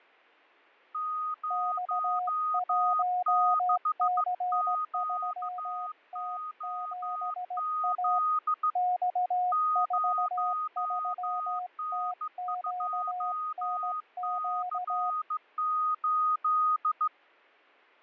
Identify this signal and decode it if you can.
Morse code, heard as two keyed tones, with fading. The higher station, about 15 wpm, 1240 Hz: 06QOZ 0N2C8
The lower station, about 17 wpm, 720 Hz: X1C3T7A X43TQNQ